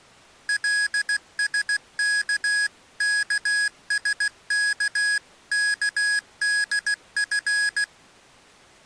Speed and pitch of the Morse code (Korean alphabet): 16 wpm, 1650 Hz

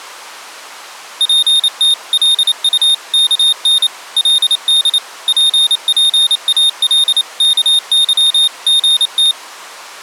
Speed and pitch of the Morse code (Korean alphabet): 28 wpm, 3650 Hz

